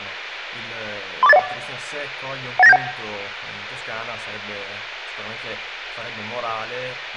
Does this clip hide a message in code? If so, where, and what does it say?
Yes: five-tone selective call (EIA) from 1.2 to 2.8 s, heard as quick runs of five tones, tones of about 30 ms. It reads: 34801 18971